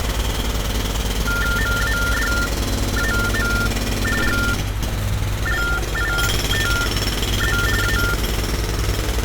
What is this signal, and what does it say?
TTY/TDD text telephone tones (45.45 baud Baudot), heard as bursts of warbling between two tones, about 400 Hz shift, 1600 Hz centre, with phone line noise and street noise. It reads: MADAM GLITZ A